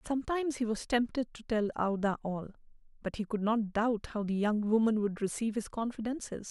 Speech in English. There is no code.